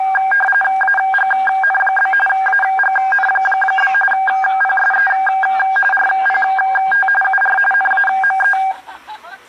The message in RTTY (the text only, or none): AGN? AGN? PSE RPT UR NAME